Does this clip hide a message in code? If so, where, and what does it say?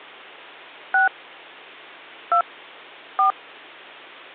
Yes: DTMF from 0.9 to 3.3 s, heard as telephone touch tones, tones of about 100 ms, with hum. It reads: 6 2 4